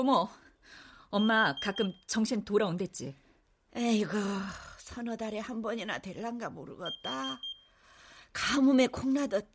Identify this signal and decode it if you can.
Alarm pattern, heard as an alarm's beeps, played twice, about 3200 Hz, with room echo and speech in Korean. Temporal four. Carbon monoxide.